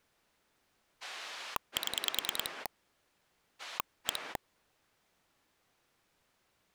Pulse dialling, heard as a rotary dial, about 10 pulses a second. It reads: 7 1